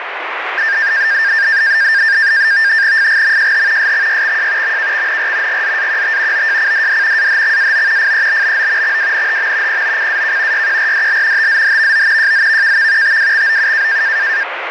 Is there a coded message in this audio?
Yes: NAVTEX (SITOR-B), 100 baud, 170 Hz shift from 0.6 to 14.4 s, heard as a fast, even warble, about 1700 Hz centre, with radio static. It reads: FGMJH SXYXJ MKXNR GZAQT OJCDD AHXAO FEBBO XWNHM POCAK YQRDL TZHVO JZVKV TWXOU